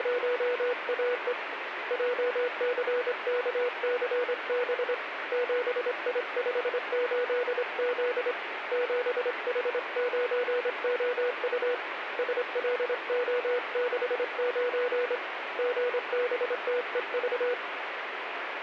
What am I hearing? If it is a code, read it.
Morse code, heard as a keyed tone, hand-sent with a straight key, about 25 wpm, 490 Hz, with radio static. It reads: … JCKCB 7I58Z 7H9OU SLO69 GBTEV